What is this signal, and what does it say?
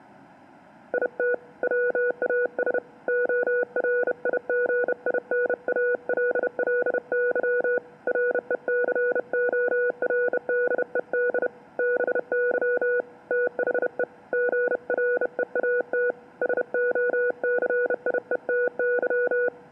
Morse code, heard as a keyed tone, hand-sent with a bug key, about 31 wpm, 490 Hz. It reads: IT WAS ORIGINALLY RECORDED BY THE GREAT SOCIETY